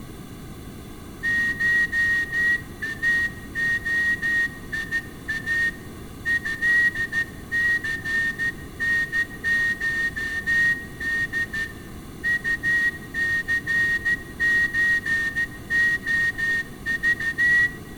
Morse code (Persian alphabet), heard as a whistle, hand-sent with a straight key, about 14 wpm, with room echo. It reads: شاعیا ضثنشد طثچعذ